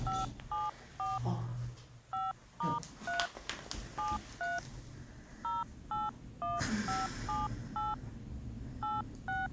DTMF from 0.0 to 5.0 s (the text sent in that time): 574 5*3 73